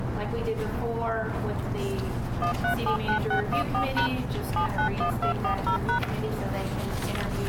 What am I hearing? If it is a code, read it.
DTMF, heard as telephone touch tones, dialled by machine, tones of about 100 ms. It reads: 1379614# 791240#